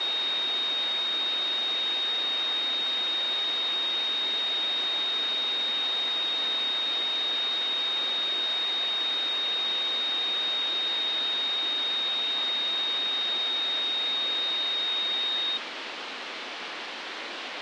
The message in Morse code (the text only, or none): none